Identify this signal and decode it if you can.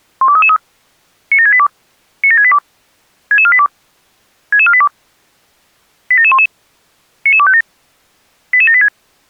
Five-tone selective call (ZVEI), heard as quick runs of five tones, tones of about 70 ms. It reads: 12333 97682 97682 66482 66482 87711 99257 88786